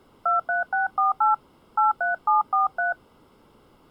DTMF, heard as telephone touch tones, dialled by hand, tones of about 140 ms. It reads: 23648 83743